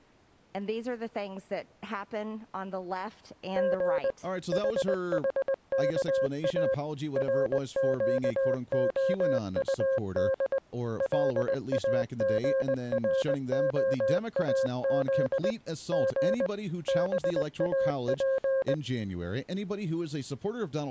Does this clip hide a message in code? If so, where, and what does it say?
Yes: Morse code (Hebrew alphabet) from 3.5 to 18.8 s, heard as a keyed tone, machine-sent, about 20 wpm, 530 Hz, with speech in English. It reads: ג חחכא רקהטד לאגרהאז ג באף